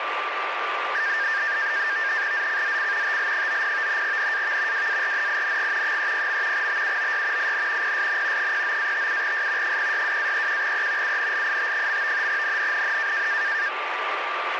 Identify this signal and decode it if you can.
NAVTEX (SITOR-B), 100 baud, 170 Hz shift, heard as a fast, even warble, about 1700 Hz centre, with radio static and a steady whistle near 1180 Hz. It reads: ZCZC TL90 NAV WARNING 30. BUOY IN PSN 09-57S 062-31E UNLIT. NNNN